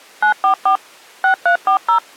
DTMF, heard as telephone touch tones, dialled by machine, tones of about 100 ms. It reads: 944 6340